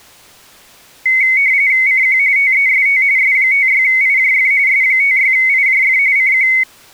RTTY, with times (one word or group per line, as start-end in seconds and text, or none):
1.9-2.2 CQ
2.4-3.0 TEST
3.2-4.5 S56IJF
4.7-6.0 S56IJF
6.2-6.5 CQ